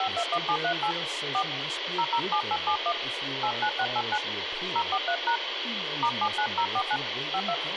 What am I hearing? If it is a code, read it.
DTMF, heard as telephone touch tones, dialled by hand, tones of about 70 ms, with radio hiss and speech in English. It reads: 521738 4 007871 89689 043# *79049 52